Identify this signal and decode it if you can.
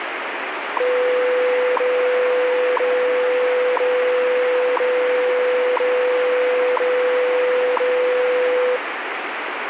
Radio time signal (WWV, Colorado), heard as ticks, one a second, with radio static.